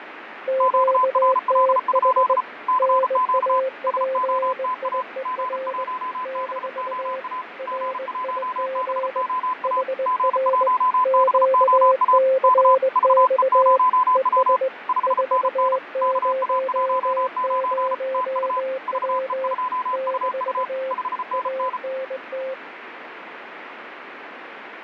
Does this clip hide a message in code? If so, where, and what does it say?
Yes: Morse code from 0.4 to 22.6 s, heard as two keyed tones, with radio static and fading. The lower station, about 20 wpm, 530 Hz: QTH NAPIER - RIG HR QCX ES 400W - ANT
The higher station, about 34 wpm, 1010 Hz: QRL? CQ SOTA G1BOA G1BOA G1BOA K VE0W 5NN KA19 TU VE2UU 5NN